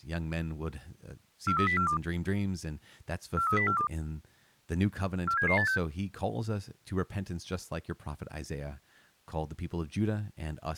Five-tone selective call (CCIR), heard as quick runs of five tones, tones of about 100 ms, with speech in English. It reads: 43042 43042 47786